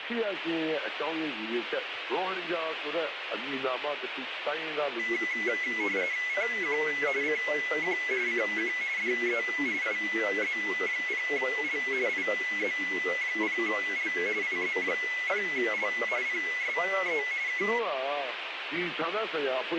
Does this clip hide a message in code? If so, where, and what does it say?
Yes: RTTY (45.45 baud, 170 Hz shift) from 5.0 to 17.8 s, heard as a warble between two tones, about 2100 Hz centre, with radio static. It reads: CQ CQ CQ DE IZ0L IZ0L IZ0L PSE K